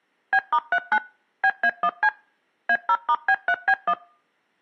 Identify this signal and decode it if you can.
DTMF, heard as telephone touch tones, dialled by machine, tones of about 60 ms. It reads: B*39 BA1C A0*B3B1